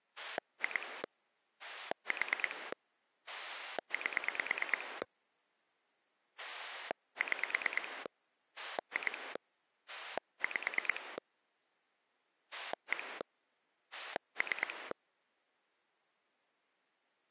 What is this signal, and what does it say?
Pulse dialling, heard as a rotary dial, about 9 pulses a second. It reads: 2 4 8 6 2 5 1 3